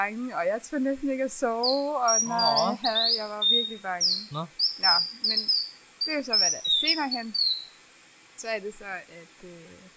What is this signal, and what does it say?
Bird-like chirps, with room echo and speech in Danish. There is no code.